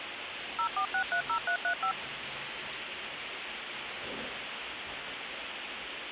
DTMF, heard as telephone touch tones, dialled by machine, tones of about 90 ms, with phone line noise and the noise of a restroom. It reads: 04630335